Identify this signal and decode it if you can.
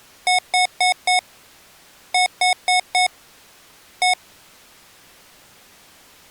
Beep code, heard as beeps from a small speaker, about 730 Hz. 4-4-1. In Phoenix BIOS tables: serial port failure.